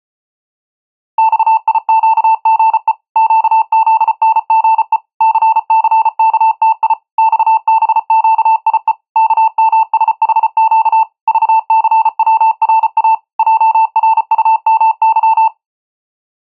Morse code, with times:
1.2-2.9 XIQGE
3.2-5.0 QZNGE
5.2-6.9 CCKTI
7.2-8.9 XBQIE
9.2-11.0 KMSHQ
11.3-13.1 VCWRA
13.4-15.5 JRUMY

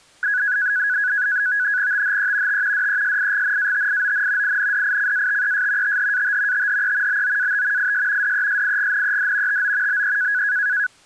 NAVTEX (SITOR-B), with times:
1.9-2.6 THE
2.5-2.9 T
2.7-4.6 DESIGNATION
4.4-6.0 INDICATES
5.8-6.7 THAT
6.5-7.2 THE
7.1-7.9 BOAT
7.8-8.3 IS
8.2-9.6 DESIGNED
9.5-10.0 TO
9.9-10.4 BE

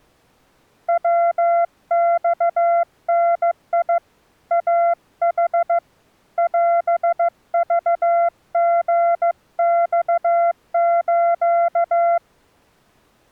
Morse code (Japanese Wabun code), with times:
0.9-4.0 ヤマダ
4.5-5.8 イヌ
6.4-12.2 オクリマス

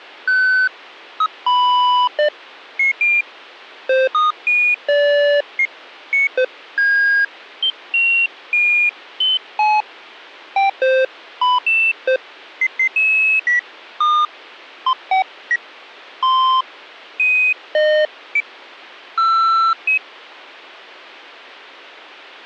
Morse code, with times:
none

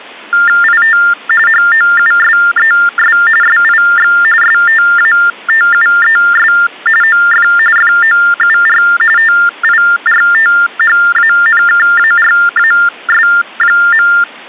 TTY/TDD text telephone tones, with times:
0.6-1.0 IT
1.5-3.2 HOUSES
3.4-4.1 SIX
4.4-6.5 STATUES
7.0-7.5 OF
7.8-8.8 FOUR
9.2-14.1 TIRTHANKARAS.

